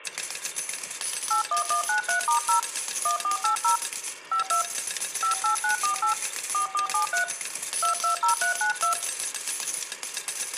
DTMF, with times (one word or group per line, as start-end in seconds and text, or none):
1.3-2.6 81193*0
3.1-3.8 1480
4.3-4.6 52
5.2-6.1 58948
6.5-7.2 4473
7.8-8.9 220392